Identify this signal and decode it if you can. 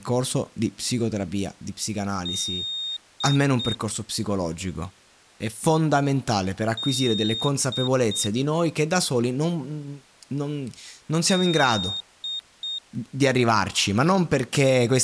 Beep code, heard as a piezo beeper, played three times, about 3700 Hz, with speech in Italian. 1 long, 2 short. In Award, IBM and AMI BIOS tables: video adapter failure.